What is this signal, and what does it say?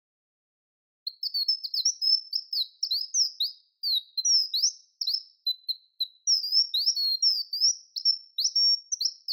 Bird-like chirps, with room echo. There is no code.